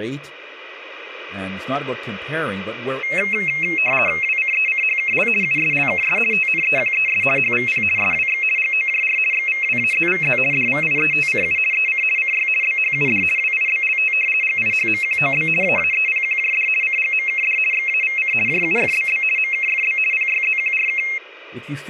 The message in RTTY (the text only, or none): WCECHKL USLKS TNEQES HVP SWX GOJR XVWAZVZ DVIETCU EC CY BHUD WIBLT GIHMQOB AAEPQJD CGMKD XAVC JUFBB MKFB PYZQRK